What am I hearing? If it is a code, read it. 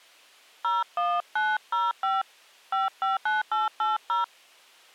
DTMF, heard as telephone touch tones, dialled by hand, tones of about 180 ms. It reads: 01905 559880